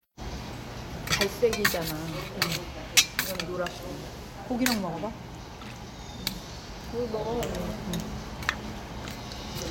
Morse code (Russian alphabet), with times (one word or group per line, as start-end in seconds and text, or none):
none